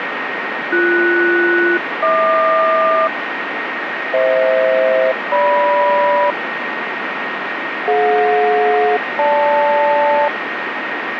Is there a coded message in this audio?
Yes: aircraft SELCAL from 0.7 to 10.3 s, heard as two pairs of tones, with radio static and a steady whistle near 1860 Hz. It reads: BS-HQ FH-GM DJ-GL